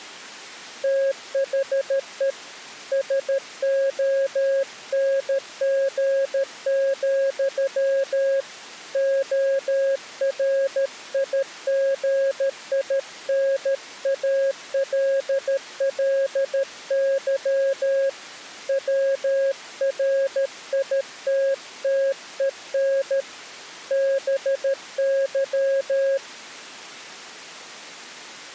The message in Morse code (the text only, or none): THE SONG, ORIGINALLY WRITTEN BY